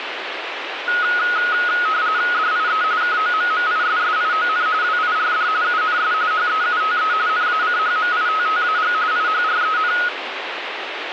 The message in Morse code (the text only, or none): none